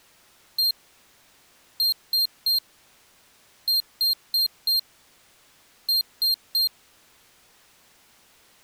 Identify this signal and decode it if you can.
Beep code, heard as a piezo beeper, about 4200 Hz. 1-3-4-3. In Phoenix BIOS tables: memory failure on data bits.